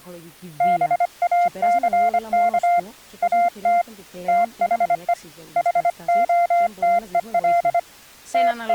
Morse code, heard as a keyed tone, hand-sent with a paddle, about 25 wpm, 700 Hz, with speech in Greek. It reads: BACK AT THE HOTEL …